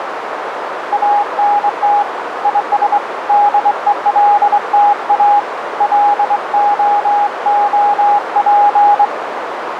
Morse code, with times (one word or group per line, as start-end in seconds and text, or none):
0.9-2.0 ANT
2.4-3.0 IS
3.3-5.4 DELTA
5.8-9.0 LOOP